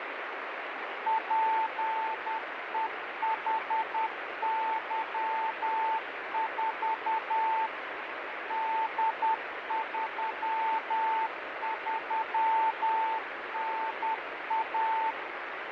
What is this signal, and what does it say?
Morse code, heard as a keyed tone, machine-sent, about 10 wpm, 890 Hz, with radio static. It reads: PEHY4 D33NA